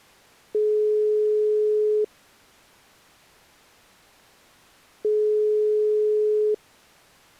Telephone call progress tone (single-tone plan, as in most of Europe), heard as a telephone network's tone, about 420 Hz, 1.5 s on and 3 s off. Ringback tone.